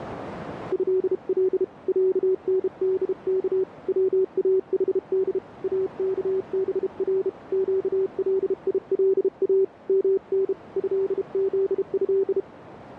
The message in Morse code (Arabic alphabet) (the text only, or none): هل عندك واحد اكبر قليلا من هذه